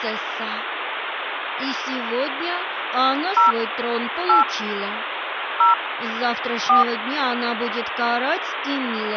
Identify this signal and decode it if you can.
DTMF, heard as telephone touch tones, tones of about 140 ms, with phone line noise. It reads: 0 8 0 4